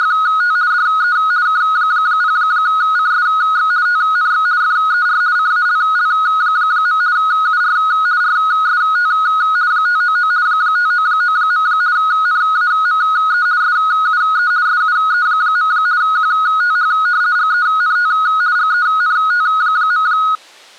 RTTY (50 baud, 170 Hz shift), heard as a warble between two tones, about 1360 Hz centre. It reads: … DE K0CSX TNX FER CALL. UR RST 599 599. NAME SUE SUE. QTH GENT GENT.